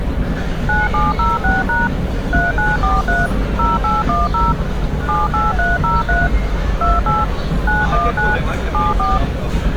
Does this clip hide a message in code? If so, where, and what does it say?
Yes: DTMF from 0.7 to 9.2 s, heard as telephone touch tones, dialled by machine, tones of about 180 ms, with street noise. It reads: 9706# 3943 0810 78303 28 919 74